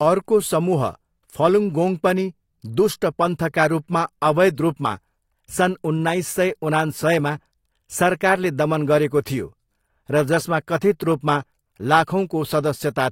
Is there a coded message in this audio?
No, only speech in Nepali.